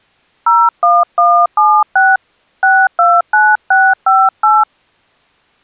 DTMF, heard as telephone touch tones, dialled by hand, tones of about 240 ms. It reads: 01176 629658